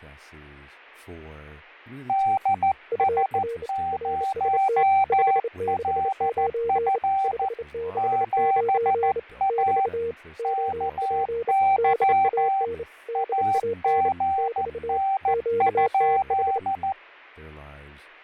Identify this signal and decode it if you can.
Morse code, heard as two keyed tones, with fading and speech in English. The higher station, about 14 wpm, 780 Hz: DS0LF 7A KY AGN?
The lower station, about 28 wpm, 460 Hz: UR RST 569 569 <BT> OP DAN DAN <BT> QTH